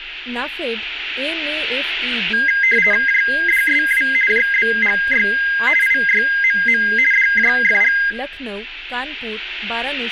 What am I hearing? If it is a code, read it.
RTTY (50 baud, 450 Hz shift), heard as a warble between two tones, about 1850 Hz centre, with radio static and speech in Bangla. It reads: JDSW JBGY IYMM DJFG